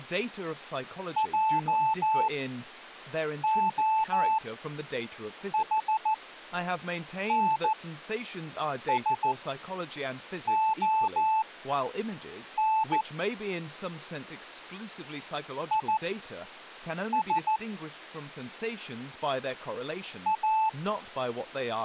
Morse code, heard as a keyed tone, machine-sent, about 14 wpm, spaced as for 6 wpm, 880 Hz, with speech in English. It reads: JOHNSON IS A